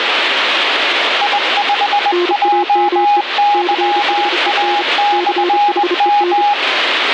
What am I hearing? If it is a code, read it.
Morse code, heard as two keyed tones, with radio static. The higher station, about 20 wpm, 820 Hz: I5JYA/M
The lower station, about 32 wpm, 350 Hz: NAME CHEN CHEN